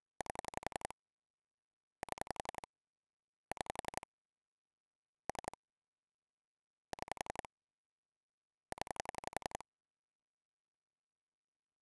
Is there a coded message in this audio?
Yes: pulse dialling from 0.2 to 9.6 s, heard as clicks on a phone line, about 11 pulses a second. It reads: 8 7 6 3 6 0